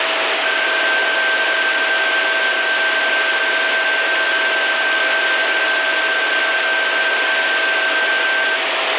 PSK31 (31.25 baud), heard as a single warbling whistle, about 1550 Hz, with radio static and a steady whistle near 650 Hz.